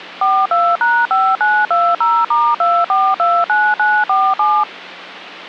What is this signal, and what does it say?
DTMF, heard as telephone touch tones, dialled by machine, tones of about 240 ms. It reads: 42#5920*2429947